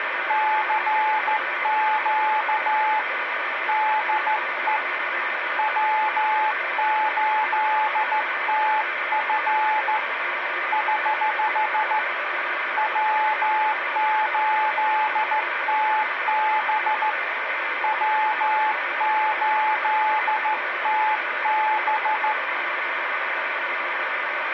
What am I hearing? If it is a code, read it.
Morse code, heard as a keyed tone, hand-sent with a straight key, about 14 wpm, 860 Hz, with radio static and a steady whistle near 430 Hz. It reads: CQ DE W8TF <HH> W8TB W8TB